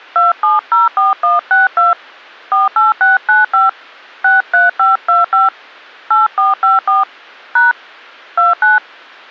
DTMF, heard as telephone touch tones, dialled by hand, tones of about 160 ms. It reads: 2704162 48695 63525 8454 # 29